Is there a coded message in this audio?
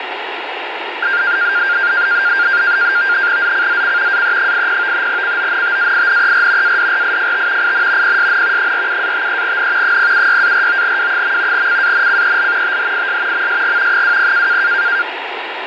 Yes: NAVTEX (SITOR-B), 100 baud, 170 Hz shift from 1.0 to 15.0 s, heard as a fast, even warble, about 1500 Hz centre, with radio static. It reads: ZCZC AE80 CONTAINER ADRIFT IN PSN 47-53N 076-49W. CANCEL THIS MSG 20